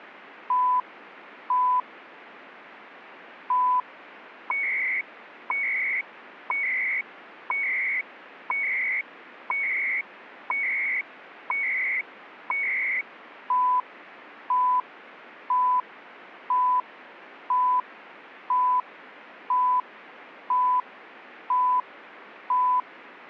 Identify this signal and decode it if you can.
Radio time signal (CHU, Canada), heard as beeps and data bursts, one a second, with radio static.